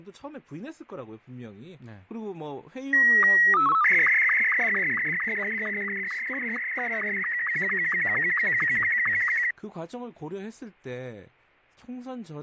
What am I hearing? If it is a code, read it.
SSTV (slow-scan television), Martin M2, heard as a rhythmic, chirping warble, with fading and speech in Korean.